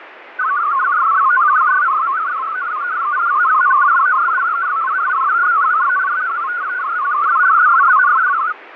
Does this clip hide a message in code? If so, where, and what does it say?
Yes: multi-tone FSK (Olivia or MFSK type), about 500 Hz wide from 0.4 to 8.5 s, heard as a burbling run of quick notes, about 62.5 baud, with radio static and fading.